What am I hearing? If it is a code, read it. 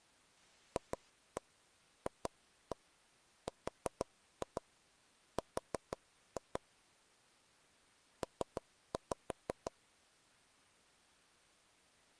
Tap code, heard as taps on a table, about 6 knocks a second. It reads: FFRR P